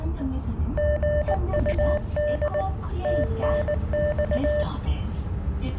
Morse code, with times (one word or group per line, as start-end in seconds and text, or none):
0.8-2.6 GUD
3.0-4.6 TNX